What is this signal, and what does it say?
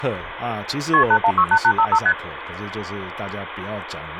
Multi-frequency trunk signalling (R1, as on North American trunks), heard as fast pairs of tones, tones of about 70 ms, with phone line noise and speech in Chinese. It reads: KP 8168855 ST